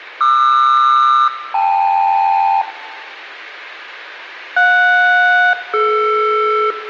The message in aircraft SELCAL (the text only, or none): QR-KL JS-DR